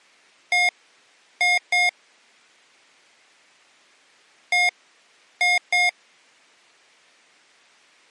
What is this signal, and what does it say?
Beep code, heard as beeps from a small speaker, played twice, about 710 Hz. 1-2.